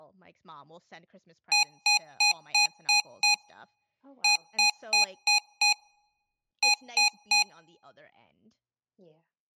Beep code, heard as beeps from a small speaker, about 830 Hz, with speech in English. 6-5-3.